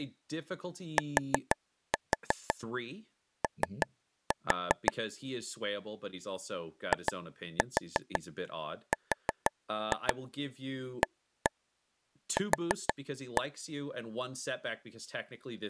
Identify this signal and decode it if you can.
Tap code, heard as taps on a table, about 6 knocks a second, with speech in English. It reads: TO IRAQ